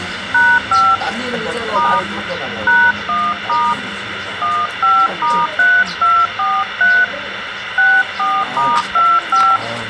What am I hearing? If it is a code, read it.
DTMF, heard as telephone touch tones, dialled by hand, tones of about 240 ms, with radio hiss and the noise of a restaurant. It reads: #5 * #1* 15*3243 64*25